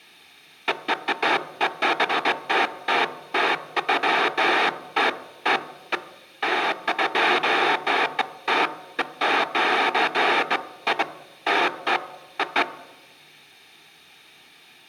Bursts of noise, with room echo. There is no code.